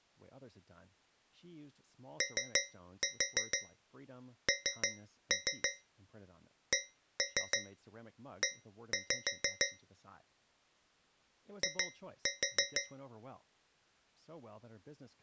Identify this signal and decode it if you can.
Tap code, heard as taps on a metal pipe, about 6 knocks a second, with speech in English. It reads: ONCE I